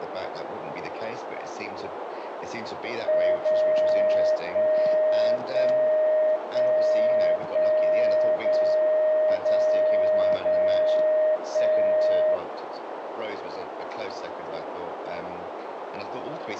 Radio time signal (DCF77), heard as a tone whose level steps once a second, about 620 Hz, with radio static and a narrow filter. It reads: 0 1 1 1 1 0 0 0 1